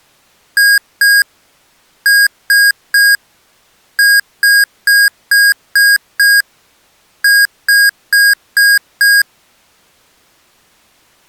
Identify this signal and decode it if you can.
Beep code, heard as beeps from a small speaker, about 1650 Hz. 2-3-6-5.